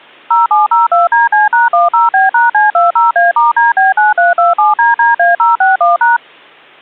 DTMF, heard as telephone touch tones, dialled by machine, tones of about 160 ms. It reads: 0702DC#10B#C20A*DB9327DDA061#